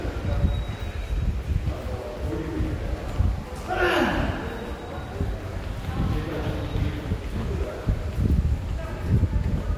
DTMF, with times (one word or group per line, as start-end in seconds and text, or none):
none